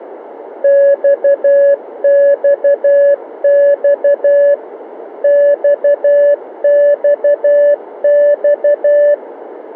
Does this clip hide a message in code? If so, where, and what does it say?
Yes: Morse code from 0.6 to 9.2 s, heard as a keyed tone, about 12 wpm, 570 Hz, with radio static. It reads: XXX XXX